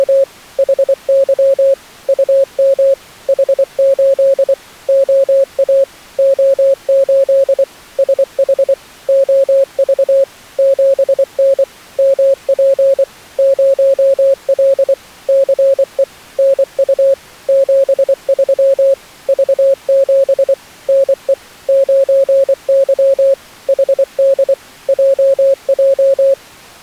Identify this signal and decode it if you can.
Morse code, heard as a keyed tone, machine-sent, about 24 wpm, 540 Hz. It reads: … HY UM H8 OA O8 SH OV 7N MP 0L CE NU 73 V7 NE 9Y HD JJ